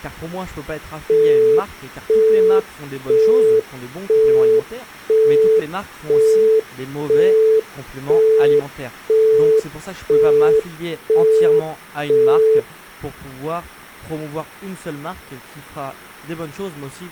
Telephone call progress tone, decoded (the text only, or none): busy tone